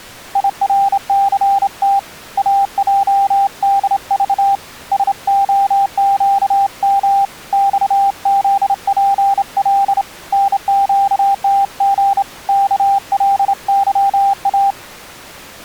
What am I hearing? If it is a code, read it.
Morse code, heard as a keyed tone, hand-sent with a straight key, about 28 wpm, 790 Hz. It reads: IRCT AJDV SOQM XZPL NQTG KLYA